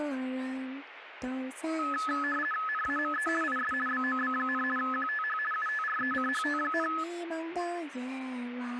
RTTY (50 baud, 450 Hz shift), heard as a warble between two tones, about 1500 Hz centre, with radio static. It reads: NAME IS BOB, QTH UTRECHT,